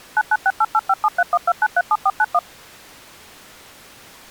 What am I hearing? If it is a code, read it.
DTMF, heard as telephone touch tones, dialled by machine, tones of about 50 ms. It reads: 9968857312937491